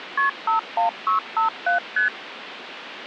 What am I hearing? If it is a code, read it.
Multi-frequency trunk signalling (R1, as on North American trunks), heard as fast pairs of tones, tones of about 120 ms, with phone line noise. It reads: KP 51657 ST